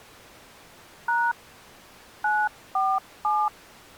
DTMF, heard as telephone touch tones, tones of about 240 ms. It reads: # 947